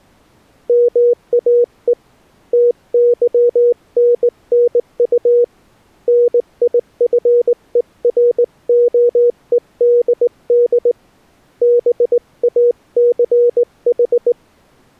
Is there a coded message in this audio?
Yes: Morse code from 0.6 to 14.4 s, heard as a keyed tone, hand-sent with a straight key, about 19 wpm, 480 Hz. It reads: MAE TYNNU NIFEROEDD BACH